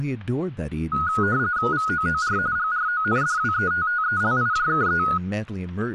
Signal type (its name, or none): RTTY